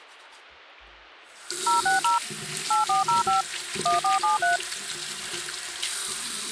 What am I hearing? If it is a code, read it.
DTMF, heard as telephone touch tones, dialled by machine, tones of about 140 ms, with the noise of a restroom. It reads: 060 8405 1473